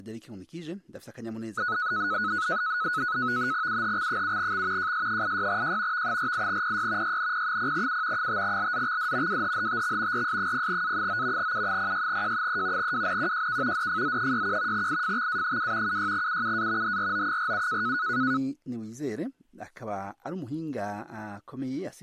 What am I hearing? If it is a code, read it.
NAVTEX (SITOR-B), 100 baud, 170 Hz shift, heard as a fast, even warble, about 1370 Hz centre. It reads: UHX7X JS86J V48PY YNP0U 5LZXD WHHTX RS0A9 U06J3 WNQJK DFZ61 IFXA2 76UUA HRO47